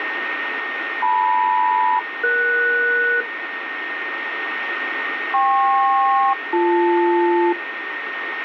Aircraft SELCAL, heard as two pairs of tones, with radio static and a steady whistle near 1840 Hz. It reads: LM-ES KP-BL